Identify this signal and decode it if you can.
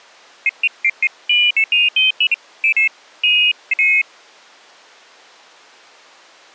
Pairs of high tones at irregular times. There is no code.